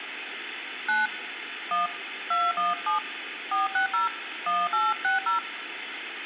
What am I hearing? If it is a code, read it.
DTMF, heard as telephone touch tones, dialled by hand, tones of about 150 ms, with phone line noise. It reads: 9 1 217 460 1860